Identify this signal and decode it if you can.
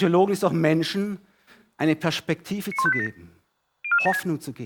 Five-tone selective call (ZVEI), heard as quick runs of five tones, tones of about 70 ms, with speech in German. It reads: 91587 04476